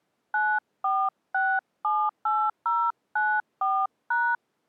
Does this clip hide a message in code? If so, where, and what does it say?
Yes: DTMF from 0.3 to 4.4 s, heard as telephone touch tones, dialled by hand, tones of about 250 ms. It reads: 94678094#